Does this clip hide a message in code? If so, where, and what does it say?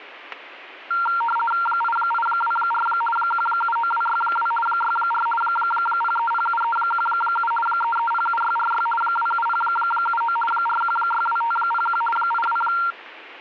Yes: RTTY (50 baud, 450 Hz shift) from 0.9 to 12.9 s, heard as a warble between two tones, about 1150 Hz centre, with static crashes. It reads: 8824 179262 64 0307317 3307646 27079 4162501 82